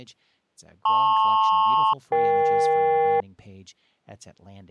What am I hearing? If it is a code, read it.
Aircraft SELCAL, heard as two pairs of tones, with speech in English. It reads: LP-EK